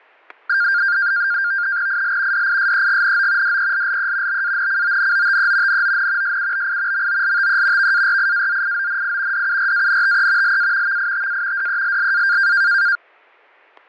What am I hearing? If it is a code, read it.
NAVTEX (SITOR-B), 100 baud, 170 Hz shift, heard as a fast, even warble, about 1500 Hz centre, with fading and static crashes. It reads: IL DISEGNO DELLE BANCONOTE NON SUBI MOLTE VARIAZIONI DURANTE LA VITA DELLA